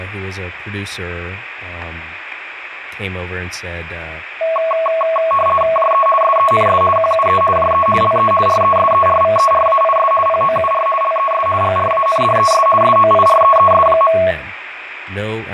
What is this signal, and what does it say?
RTTY (50 baud, 450 Hz shift), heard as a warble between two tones, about 880 Hz centre, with radio static, room echo and speech in English. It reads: JE SENS QUE JE LE RESERVERAIS POUR LES GRANDES SOIREES.